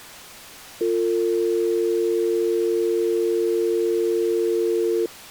Telephone call progress tone (North American or UK plan), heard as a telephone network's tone, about 350, 450 Hz. Dial tone.